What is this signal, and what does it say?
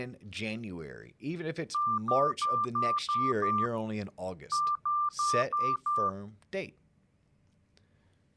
Beep code, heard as beeps, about 1190 Hz, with speech in English. 6-5.